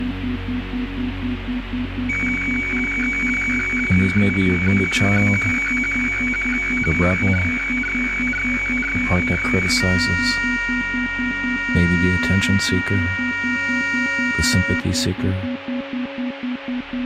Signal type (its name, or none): weather fax (radiofax)